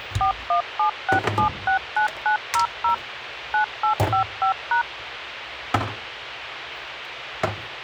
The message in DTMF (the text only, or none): 4176769900 9855#